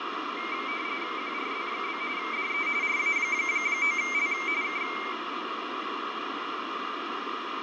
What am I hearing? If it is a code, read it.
RTTY (45.45 baud, 170 Hz shift), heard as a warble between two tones, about 2200 Hz centre, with radio static and fading. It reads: QRZ? DE RA9L K